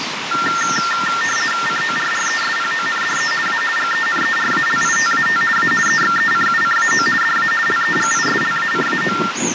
RTTY (50 baud, 450 Hz shift), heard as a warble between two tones, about 1600 Hz centre, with radio static and the noise of a park. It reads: CORRESPONDE A GENERALITAT A EXECUCAO DA LEGISLACAO